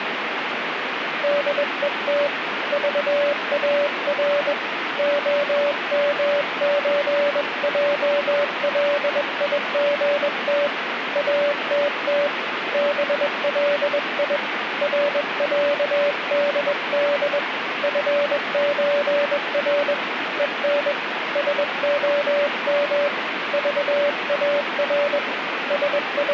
Morse code (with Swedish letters), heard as a keyed tone, hand-sent with a bug key, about 21 wpm, 580 Hz, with radio static. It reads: DET VAR OMÖJLIGT ATT BLI RÄDD FÖR EN SOM VAR …